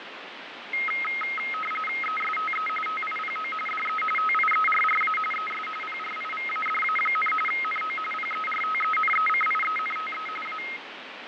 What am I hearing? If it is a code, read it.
RTTY (45.45 baud, 850 Hz shift), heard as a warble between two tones, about 1700 Hz centre, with radio static and fading. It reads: ESTE TIPO DE TIERRA ES PRIVADA, NO PERTENECIENTE A